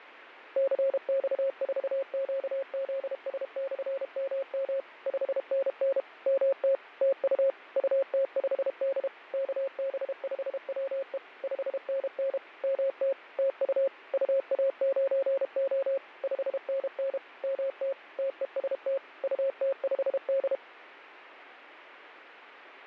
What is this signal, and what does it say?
Morse code, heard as a keyed tone, machine-sent, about 32 wpm, 540 Hz, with radio static and fading. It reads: CX4QZS/MM 5NN MT TU UT5D KB5WE 5NN MT TU UA9O 5NN MT TEST UT5D